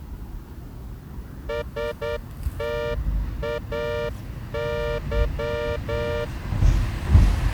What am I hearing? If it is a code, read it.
Morse code, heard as a horn, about 9 wpm, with the noise of a residential street. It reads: STAY